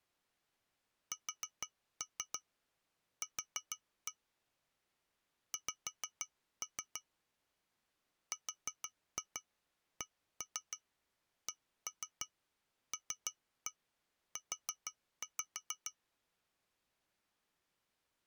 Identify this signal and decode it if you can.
Tap code, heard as taps on glass, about 6 knocks a second. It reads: SQ X RCCLU